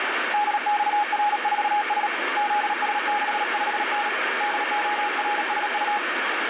Morse code, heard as a keyed tone, hand-sent with a paddle, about 37 wpm, 830 Hz, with heavy radio static. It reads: DXR4S ZS65N DORSU